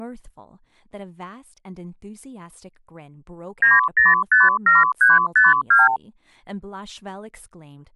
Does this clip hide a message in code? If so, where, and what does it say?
Yes: multi-frequency trunk signalling (R2, with the far end's replies) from 3.6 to 6.0 s, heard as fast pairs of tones, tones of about 170 ms, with speech in English. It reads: 9057352